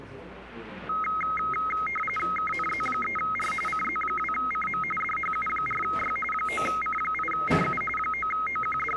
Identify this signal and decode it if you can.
RTTY (45.45 baud, 850 Hz shift), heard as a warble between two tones, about 1700 Hz centre, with the noise of a cafe. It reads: KNZ3R CZ2CM DHU4Y 9C8CU …